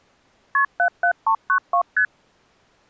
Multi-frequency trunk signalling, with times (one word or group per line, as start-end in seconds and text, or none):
0.5-0.6 KP
0.8-1.8 77392
2.0-2.1 ST